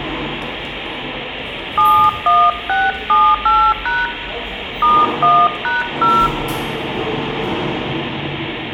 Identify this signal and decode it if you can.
DTMF, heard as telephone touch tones, dialled by hand, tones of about 230 ms, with the noise of a subway station. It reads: 71678# *1#0